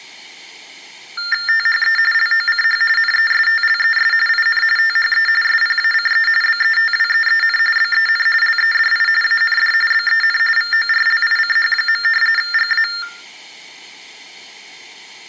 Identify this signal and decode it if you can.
TTY/TDD text telephone tones (45.45 baud Baudot), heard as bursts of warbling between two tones, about 400 Hz shift, 1600 Hz centre. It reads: THE LOCH NESTLES IN THE SPACE BETWEEN BEN LEDI AND BEN VORLICH. GA